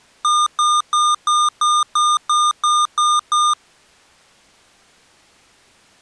Beep code, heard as beeps from a small speaker, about 1210 Hz. 10 short. In AMI BIOS tables: CMOS shutdown register error.